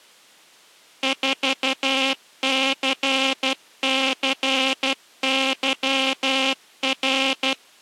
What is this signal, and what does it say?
Morse code, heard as a buzzer, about 12 wpm. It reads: 4CCYR